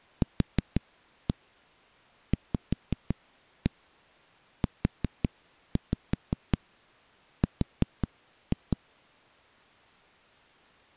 Tap code, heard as knocks on a wall, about 5 knocks a second. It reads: QVUR